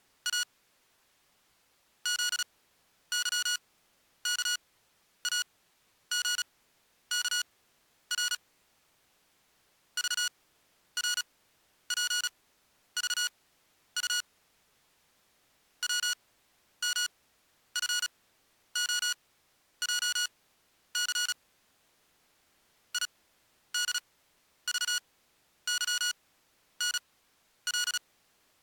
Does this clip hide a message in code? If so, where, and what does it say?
Yes: Morse code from 0.2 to 28.0 s, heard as electronic beeps, machine-sent, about 36 wpm, spaced as for 11 wpm, 1450 Hz. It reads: A ZYKAGKR VRPVU WMFOJC IDVYNL